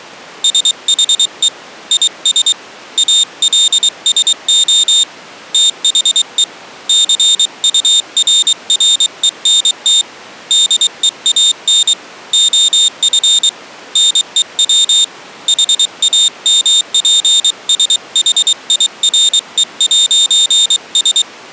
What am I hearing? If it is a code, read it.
Morse code, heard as a high beeper, hand-sent with a paddle, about 23 wpm, 3650 Hz. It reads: SHE IS ALSO THE CURRENT DEAN OF NEW HAMPSHIRE'S